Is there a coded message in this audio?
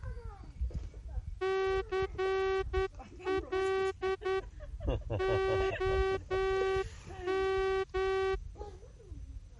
Yes: Morse code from 1.4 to 8.4 s, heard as a horn, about 10 wpm, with the noise of a park. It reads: CL OM